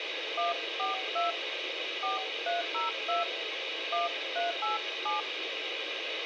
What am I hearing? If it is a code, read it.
DTMF, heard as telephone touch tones, dialled by hand, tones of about 150 ms, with radio hiss and a squelch burst at the end. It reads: 142 4302 1387